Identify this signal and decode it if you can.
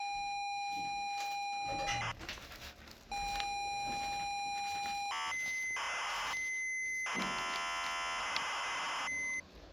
ZX Spectrum tape loading, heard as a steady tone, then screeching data, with the noise inside a lift.